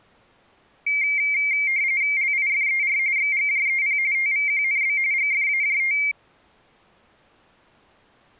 RTTY (45.45 baud, 170 Hz shift), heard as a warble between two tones, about 2200 Hz centre. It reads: LIFER XGJEP TVQNB GFAJT